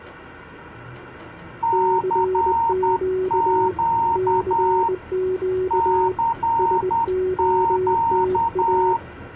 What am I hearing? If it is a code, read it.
Morse code, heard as two keyed tones, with the noise inside a bus. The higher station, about 10 wpm, 920 Hz: CQ CQ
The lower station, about 20 wpm, 370 Hz: CQ CQ SOTA